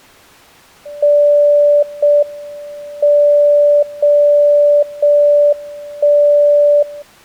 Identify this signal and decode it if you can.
Radio time signal (JJY), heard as a tone whose level steps once a second, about 580 Hz. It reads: 0 M 0 0 1 0